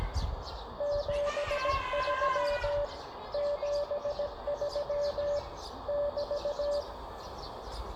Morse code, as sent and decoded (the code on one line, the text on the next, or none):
--... ...-- / --... ...-- / -...-
73 73 <BT>